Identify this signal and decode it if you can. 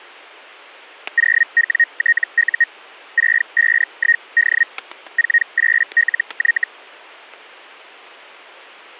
Hellschreiber (Feld-Hell, 122.5 baud), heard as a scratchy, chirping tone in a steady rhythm, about 1850 Hz, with static crashes. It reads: 0WTU 651D 48LY